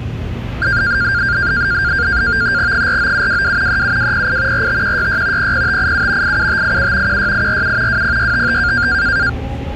NAVTEX (SITOR-B), 100 baud, 170 Hz shift, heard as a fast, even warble, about 1500 Hz centre, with the noise inside a subway train. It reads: 49722 37208 45166 00587 87587 16847 20655